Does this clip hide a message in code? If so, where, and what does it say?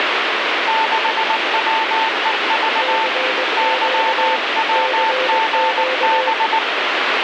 Yes: Morse code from 0.6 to 6.6 s, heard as two keyed tones, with heavy radio static. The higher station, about 19 wpm, 890 Hz: 6WEV YWGB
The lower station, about 21 wpm, 520 Hz: CQ CQ